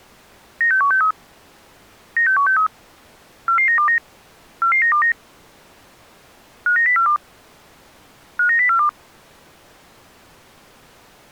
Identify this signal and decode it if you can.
Five-tone selective call (CCIR), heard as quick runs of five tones, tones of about 100 ms. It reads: 96163 96163 44929 44929 59042 59042